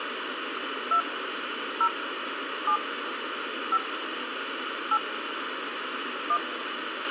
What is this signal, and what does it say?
DTMF, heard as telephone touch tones, dialled by hand, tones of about 70 ms, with radio hiss and a squelch burst at the end. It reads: 2 0 7 5 8 1